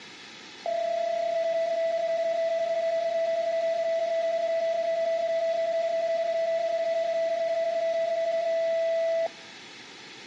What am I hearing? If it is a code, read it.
PSK31 (31.25 baud), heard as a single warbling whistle, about 660 Hz.